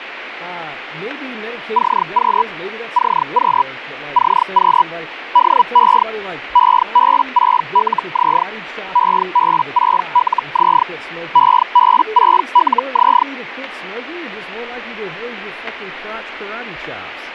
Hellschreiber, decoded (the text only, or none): CQ CQ CQ DE EB6LZ EB6LZ EB6LZ